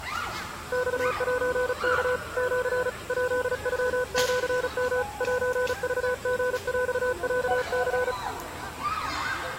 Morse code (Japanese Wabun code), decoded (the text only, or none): マセワ シ ヱノシヨ セクリヰロニ